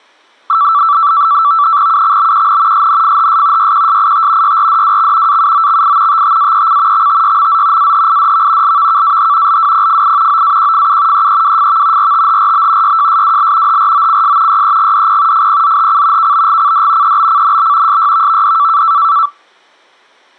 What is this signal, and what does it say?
NAVTEX (SITOR-B), 100 baud, 170 Hz shift, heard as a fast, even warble, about 1240 Hz centre. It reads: UXBQN SNFHS YQSIT YRDWX AUOXI TTAEC XTYMZ AHIDV LVKAH LWPFI OAQFU EEWFV RTHRB YJSWL HROCS YEGDP FPZHC KBGCD EBCNB SYVVD